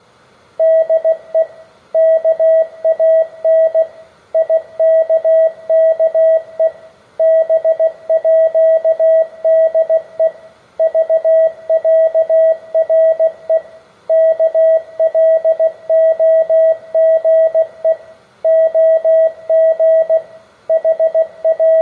Morse code (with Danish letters), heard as a keyed tone, machine-sent, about 16 wpm, 650 Hz, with room echo. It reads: DE KAN IKKE BÅDE VÆRE KLOGE OG …